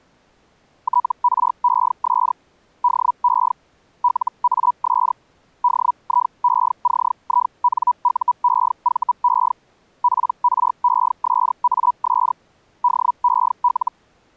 Hellschreiber (Feld-Hell, 122.5 baud), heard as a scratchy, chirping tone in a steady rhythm, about 980 Hz. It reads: TRES DE LAS DIECINUEVE PRESAS DEL